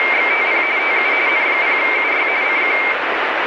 RTTY (45.45 baud, 170 Hz shift), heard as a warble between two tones, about 2200 Hz centre, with radio static. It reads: … TU N0UY CQ